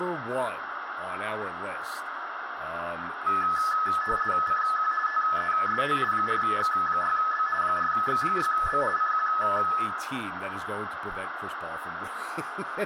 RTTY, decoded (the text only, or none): CQ TEST 4X6B 4X6B CQ